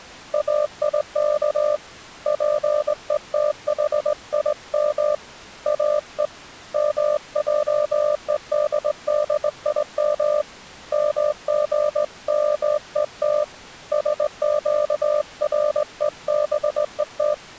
Morse code (Hebrew alphabet), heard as a keyed tone, hand-sent with a straight key, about 19 wpm, 600 Hz. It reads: איך פותחים או מעודדים מגמות שקרובות